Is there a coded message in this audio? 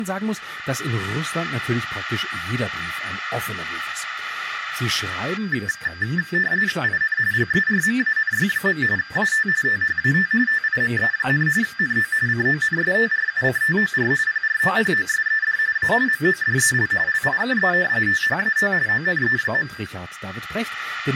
Yes: RTTY (45.45 baud, 170 Hz shift) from 5.4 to 19.9 s, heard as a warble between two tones, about 1700 Hz centre, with speech in German. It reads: IN GERMANY. AT THAT TIME, NO CONSTRUCTOR PROPOSED A MODEL LIKE THAT ONE.